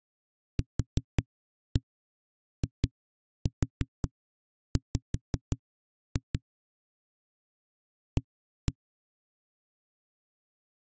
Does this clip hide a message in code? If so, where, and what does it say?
Yes: tap code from 0.6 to 8.8 s, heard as knocks on a wall, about 5 knocks a second. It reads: QIW A